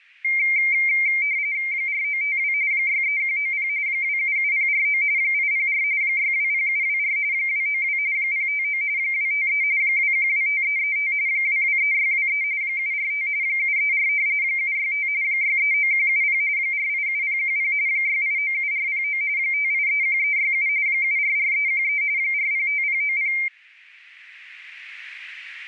RTTY (45.45 baud, 170 Hz shift), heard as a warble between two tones, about 2200 Hz centre. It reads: 4952 63190 277049 804 620724 292 059 253 2125335 223623 745 734 765 639170 487010 6897409 5831367 744313 405090